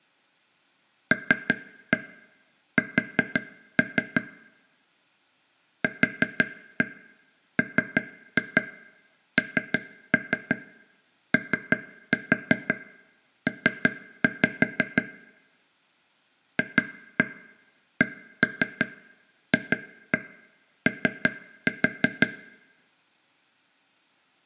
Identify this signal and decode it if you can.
Tap code, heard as taps on a table, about 5 knocks a second, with room echo. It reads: LS QMNOP FCFO